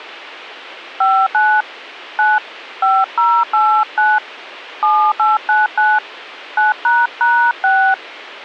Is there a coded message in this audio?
Yes: DTMF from 1.0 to 7.9 s, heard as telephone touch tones, dialled by hand, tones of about 240 ms. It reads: 59 9 5089 7899 9##6